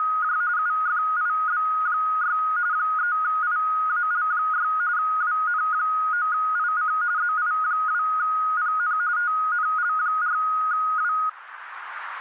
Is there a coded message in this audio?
Yes: RTTY (45.45 baud, 170 Hz shift) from 0.0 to 11.3 s, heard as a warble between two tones, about 1350 Hz centre, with radio static. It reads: … UFIB6 3IAL6 WN9IC ZI2PN TNL4W